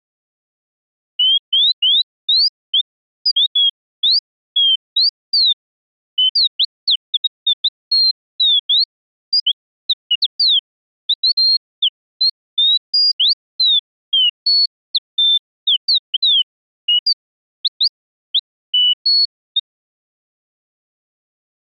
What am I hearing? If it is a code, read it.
Bird-like chirps. There is no code.